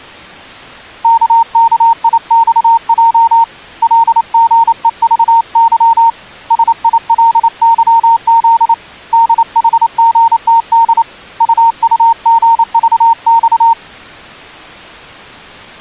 Morse code, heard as a keyed tone, hand-sent with a paddle, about 28 wpm, 920 Hz. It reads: KKIXJ LGEVY SILYZ DHGTD UUGVX